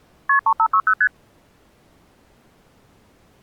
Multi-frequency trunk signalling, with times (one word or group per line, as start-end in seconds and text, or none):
0.3-0.4 KP
0.5-0.9 3560
1.0-1.1 ST